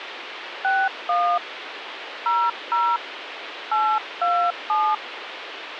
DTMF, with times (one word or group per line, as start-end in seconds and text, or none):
0.6-1.4 61
2.3-3.0 00
3.7-4.9 827